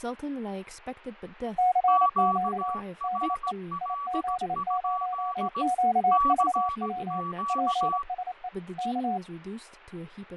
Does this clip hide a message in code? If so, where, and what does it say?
Yes: Morse code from 1.5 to 9.2 s, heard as two keyed tones, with radio static, fading and speech in English. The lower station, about 28 wpm, 730 Hz: CQ DE IZ0QVW PSE K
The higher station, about 17 wpm, 1140 Hz: QRL? CQ